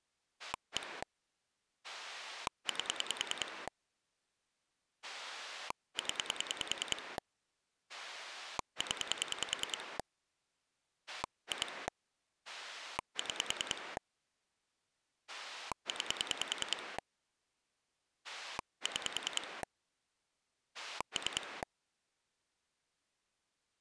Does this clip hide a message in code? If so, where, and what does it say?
Yes: pulse dialling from 0.4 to 21.6 s, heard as a rotary dial, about 10 pulses a second. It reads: 1 8 0 0 2 6 9 6 3